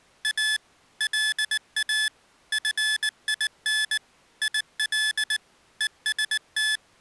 Morse code, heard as electronic beeps, machine-sent, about 19 wpm, 1750 Hz. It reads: A LA FIN IL EST